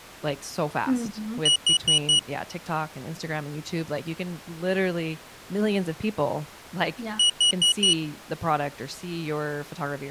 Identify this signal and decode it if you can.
Alarm pattern, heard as an alarm's beeps, played twice, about 2900 Hz, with speech in English. Temporal four. Carbon monoxide.